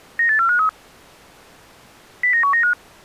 Five-tone selective call (CCIR), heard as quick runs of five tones, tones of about 100 ms. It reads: 98453 09195